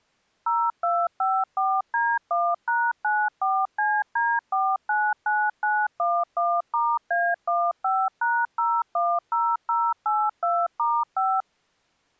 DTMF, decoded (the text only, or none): 0254D1#94CD499911*A15#010082*5